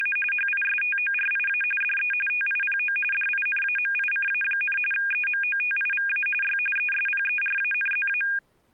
RTTY (45.45 baud, 850 Hz shift), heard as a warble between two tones, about 2050 Hz centre. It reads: … HISTORIA DE TIPO DINAMICA, EMOTIVA Y ESPERANZA